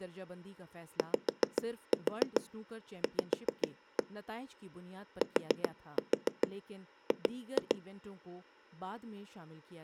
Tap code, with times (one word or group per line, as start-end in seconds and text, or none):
1.0-4.0 YV
5.2-7.8 TG